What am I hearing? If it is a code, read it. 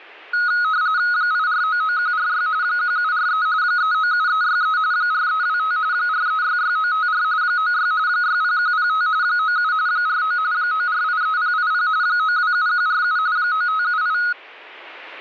RTTY (45.45 baud, 170 Hz shift), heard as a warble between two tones, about 1360 Hz centre. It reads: 8499146 1743 397363 4325 4366954 96 60105 97 49 9483080 927147 9578